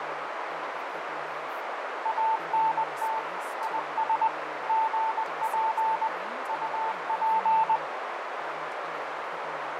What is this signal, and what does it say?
Morse code, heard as a keyed tone, machine-sent, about 20 wpm, 890 Hz, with heavy radio static, fading, a narrow filter and speech in English. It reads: ANT IS GP UP